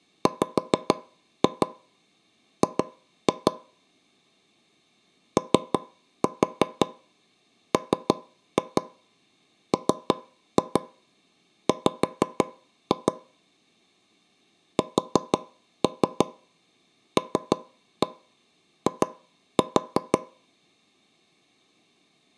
Tap code, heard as taps on a table, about 6 knocks a second. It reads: WG OMMW SLI